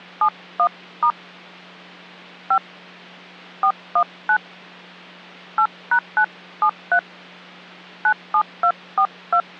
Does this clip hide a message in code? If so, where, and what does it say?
Yes: DTMF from 0.2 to 9.4 s, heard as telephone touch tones, dialled by hand, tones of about 80 ms, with hum. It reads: 71* 5 419 8#973 97242